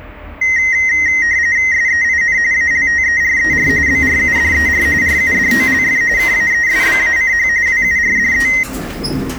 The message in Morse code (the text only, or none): none